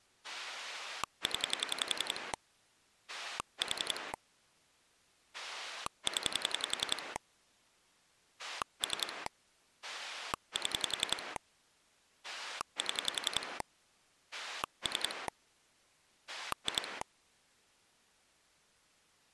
Pulse dialling, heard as a rotary dial, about 11 pulses a second. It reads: 0 4 0 3 7 7 3 2